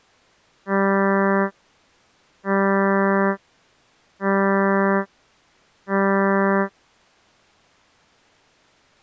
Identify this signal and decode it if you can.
Ship horn signal, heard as a ship's horn, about 200 Hz. 4 short. At sea: a pilot vessel's identity signal in fog.